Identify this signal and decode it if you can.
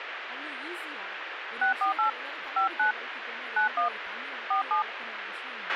DTMF, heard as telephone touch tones, dialled by hand, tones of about 120 ms, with radio hiss, a squelch burst at the end and speech in English. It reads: 648 59 91 47